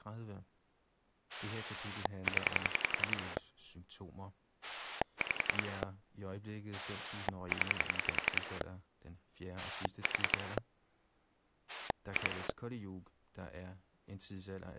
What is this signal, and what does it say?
Pulse dialling, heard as a rotary dial, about 10 pulses a second, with speech in Danish. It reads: 0 5 0 4 2